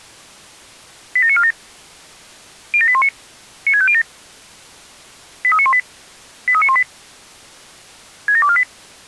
Five-tone selective call (ZVEI), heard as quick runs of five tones, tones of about 70 ms. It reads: 87947 07819 96507 83918 83918 67248